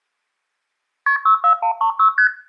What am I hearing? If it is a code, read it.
Multi-frequency trunk signalling (R1, as on North American trunks), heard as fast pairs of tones, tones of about 100 ms, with room echo. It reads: KP 64136 ST